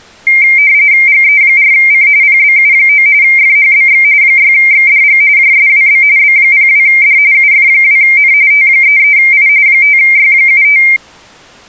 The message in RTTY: GE4C PBU9 FHBX 6XDG JSWB B02D UF2N T33I 5Y75

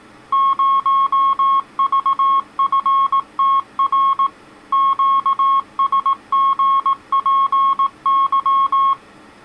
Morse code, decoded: 0VFTR QSGPY

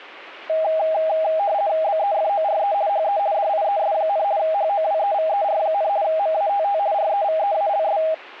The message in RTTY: BEFORE HE DIES, HOWEVER, MATT REVEALS

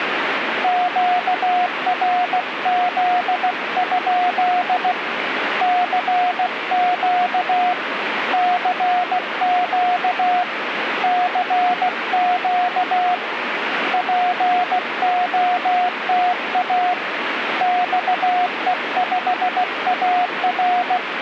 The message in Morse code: QRZ? CQ CQ CQ POTA XE5AR

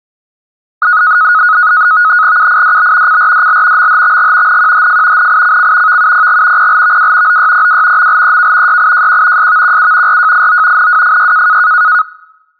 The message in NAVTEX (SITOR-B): UIDB CRDL MHXG NQHF NICC VUPG PLVW OYPW MLEK YIJQ SVQU RJIO NWFY

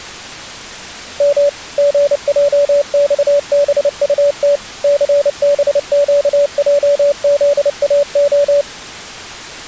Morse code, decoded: M GJXBUT CBQJZAO

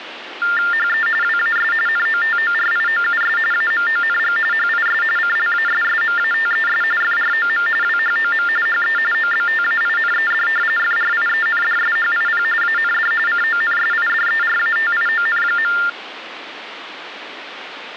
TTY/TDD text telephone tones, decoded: HE WAS NOTORIOUS AMONG HIS CLASSMATES FROM WHOM HE OBTAINED FRIENDSHIP AND CONSIDERATION.

